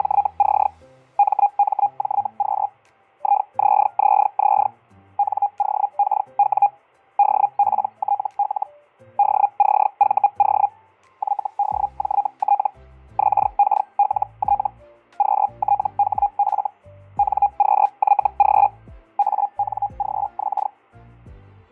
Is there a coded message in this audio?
Yes: Hellschreiber (Feld-Hell, 122.5 baud) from 0.0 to 20.7 s, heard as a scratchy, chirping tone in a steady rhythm, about 810 Hz, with fading. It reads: … MMJQ IZZZ NOKW DPTL DCVO YDJT XKLT QTHF NQYG ANGX